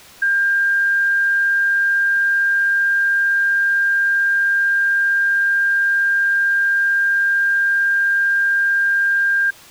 A steady tone. There is no code.